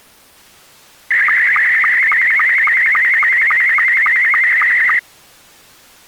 SSTV (slow-scan television), Scottie S2, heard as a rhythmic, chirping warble.